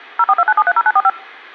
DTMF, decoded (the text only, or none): 0429730945